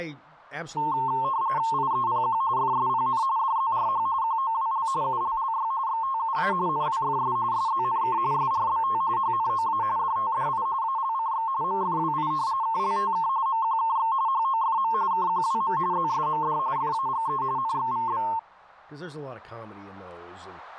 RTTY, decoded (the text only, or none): IEPQ FSPN DZRH QOWL ULLY XTUA NWFS SZNK SRBT HNOA DTDI ALCX MFWI KLTK MQKX HOFM KQWM ZSMD FAGE NXVB